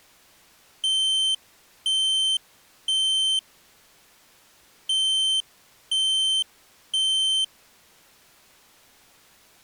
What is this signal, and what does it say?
Alarm pattern, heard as an alarm's beeps, played twice, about 3100 Hz. Temporal three. Smoke or fire, evacuate.